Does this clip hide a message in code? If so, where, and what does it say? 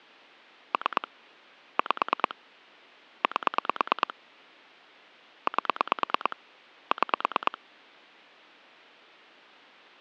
Yes: pulse dialling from 0.7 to 7.6 s, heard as clicks on a phone line, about 9 pulses a second. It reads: 3 5 8 8 6